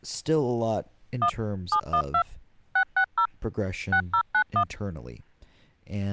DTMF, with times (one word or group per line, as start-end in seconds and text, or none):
1.2-1.3 1
1.7-2.2 712
2.8-3.3 660
3.9-4.6 6091